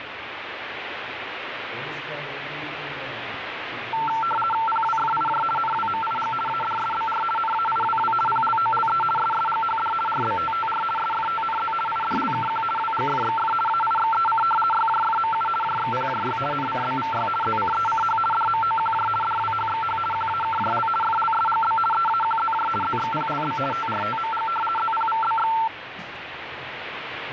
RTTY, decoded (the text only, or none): PWFIJ NWMIG ADSBR NAIWW PLOLE SSGHD RBTTR SFTNZ IDLKQ WGFXF AIXEC YJFMU JXPJY NCBVY ZCECH DMOQJ DWHXH QAKJL FLSGB EAQZJ ZXPLB TRTMG ZPVBX